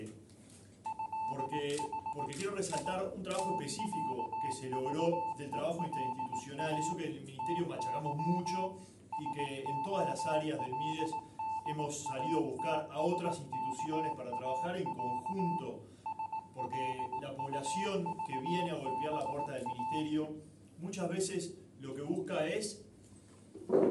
Morse code (Russian alphabet), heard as a keyed tone, machine-sent, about 18 wpm, 880 Hz, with room echo. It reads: ЭХ И ТЯЖЕЛА ТЫ СОЛДАТСКАЯ СЛУЖБА